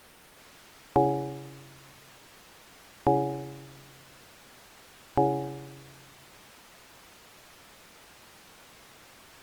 Clock strike, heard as a bell. 3. Three o'clock.